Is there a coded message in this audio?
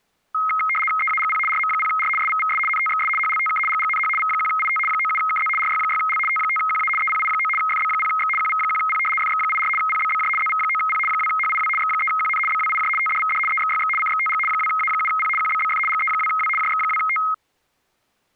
Yes: RTTY (75 baud, 850 Hz shift) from 0.3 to 17.3 s, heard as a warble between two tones, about 1700 Hz centre. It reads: EAGP RM0R SVVS NTXS HLTK GGNH V1IT 97KZ RY6L T5QA EPI9 FB0X QV1P FX84 PBBJ ZV9P 2HIW X3QN BWIJ TDVD EXYX CXTG 2A7P QBBF GE2W JX2T